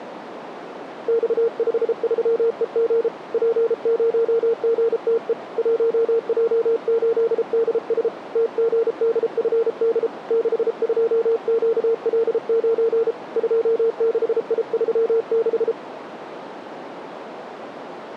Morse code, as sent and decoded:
-..- ..... ...-- . --. / .--. ----- --. - . / .---- .--- ---.. -.. ... / - --. -.. ..-. -.. / -.... ..--- --.- .-.. ----. / ..--- -.... .. ...-- -....
X53EG P0GTE 1J8DS TGDFD 62QL9 26I36

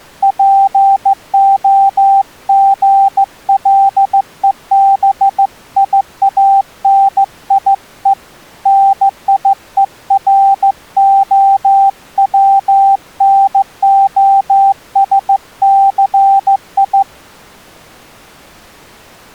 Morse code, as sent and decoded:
.--. --- --. .-.. . -... .. .- -. .. . / -. .. . .-. --- .-- -. --- ... -.-. ..
POGLEBIANIE NIEROWNOSCI

